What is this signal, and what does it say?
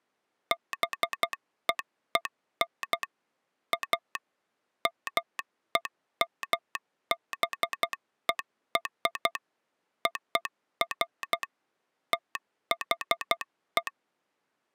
Morse code (American railroad code), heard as a telegraph sounder, machine-sent. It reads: BEEN A MEMBER OF THE